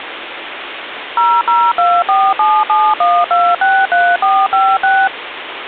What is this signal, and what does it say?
DTMF, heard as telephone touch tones, dialled by machine, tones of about 240 ms, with phone line noise. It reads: 0024771263456